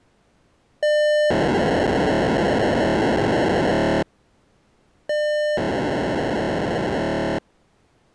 POCSAG pager data (1200 baud), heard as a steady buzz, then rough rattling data.